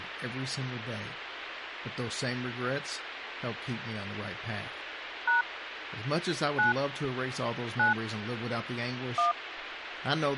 DTMF, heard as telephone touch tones, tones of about 140 ms, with phone line noise and speech in English. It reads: # 9 9 1